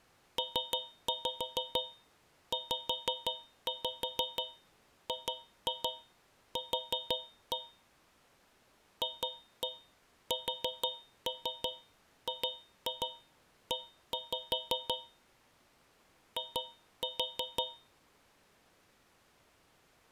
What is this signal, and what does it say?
Tap code, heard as taps on a metal pipe, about 6 knocks a second. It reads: PZGQ FSGE I